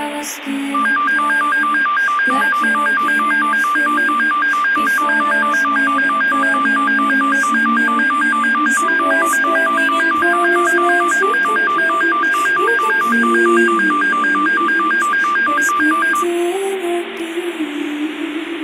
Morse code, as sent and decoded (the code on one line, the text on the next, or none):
none